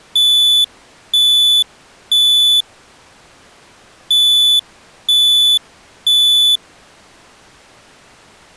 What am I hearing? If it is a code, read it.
Alarm pattern, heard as an alarm's beeps, played twice, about 3500 Hz. Temporal three. Smoke or fire, evacuate.